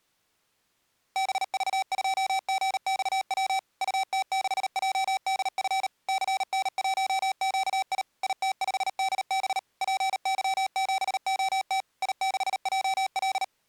Morse code, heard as electronic beeps, machine-sent, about 38 wpm, 770 Hz. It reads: BV2GXW UT6JDF CN1QI IT5DB PY7OT I6JL